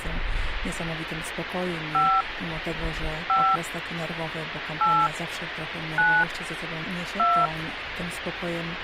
DTMF, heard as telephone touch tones, dialled by hand, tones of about 260 ms, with phone line noise. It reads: 5 5 8 9 2